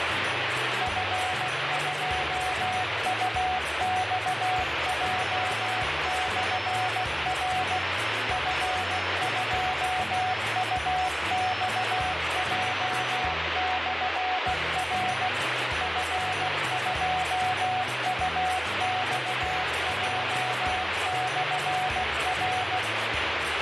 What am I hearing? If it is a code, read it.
Morse code, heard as a keyed tone, machine-sent, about 16 wpm, 740 Hz, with heavy radio static. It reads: F2UXJ/R F2UXJ/R F2UXJ/R